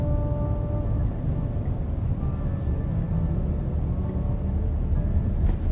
The noise inside a car. There is no code.